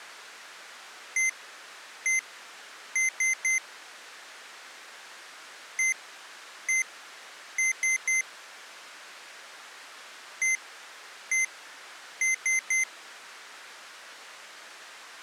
Beep code, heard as beeps from a small speaker, played three times, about 2050 Hz. 1-1-3. In Phoenix BIOS tables: CMOS read or write failure.